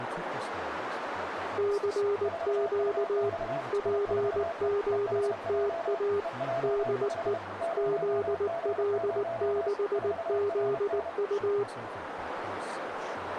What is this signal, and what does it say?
Morse code, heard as two keyed tones, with radio static, a narrow filter and speech in English. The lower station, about 19 wpm, 410 Hz: CQ POTA DE ZL6ZU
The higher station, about 31 wpm, 670 Hz: 4UX I4E EHJ EJ5 0G0 4RN